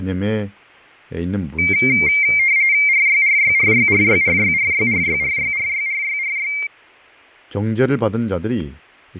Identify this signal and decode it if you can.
RTTY (45.45 baud, 170 Hz shift), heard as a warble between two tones, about 2200 Hz centre, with fading, static crashes and speech in Korean. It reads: RYRYRYRYRYRYRYRYRYRYRY